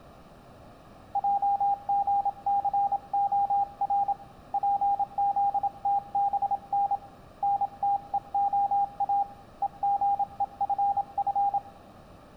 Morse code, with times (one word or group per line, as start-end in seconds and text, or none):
1.2-4.1 JGCOR
4.5-6.9 PZTBN
7.4-9.2 NTEOA
9.6-11.6 EGEFF